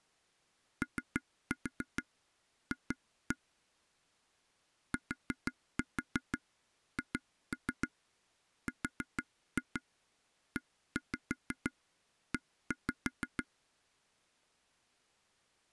Tap code, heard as taps on a table, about 6 knocks a second. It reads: OF THREE